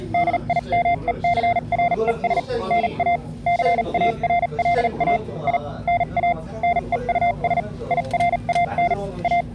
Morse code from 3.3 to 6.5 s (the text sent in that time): CARLA I NA